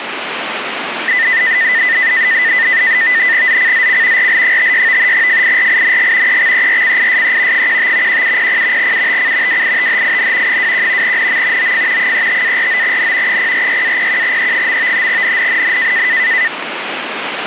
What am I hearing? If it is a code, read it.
NAVTEX (SITOR-B), 100 baud, 170 Hz shift, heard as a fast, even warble, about 1900 Hz centre, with radio static. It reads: ZCZC RL56 FIRING EXERCISE 15 1700 UTC WITHIN 21 NM OF 35-49N 046-01E. NNNN